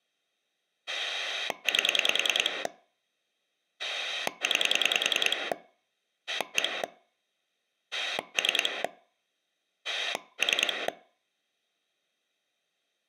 Pulse dialling, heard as a rotary dial, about 10 pulses a second. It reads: 8 9 1 3 3